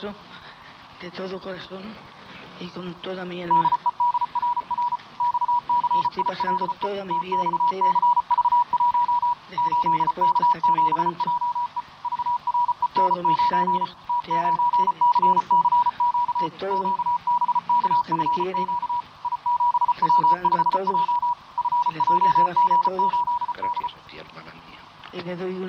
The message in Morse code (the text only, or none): DEDRR XCILE TXCV1 8K7JE VREN9 T9CCQ QBKFQ I7W5J FJG8D